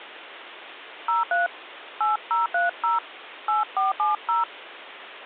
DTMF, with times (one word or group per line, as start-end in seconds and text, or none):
1.1-1.5 03
2.0-3.0 8030
3.5-4.4 8470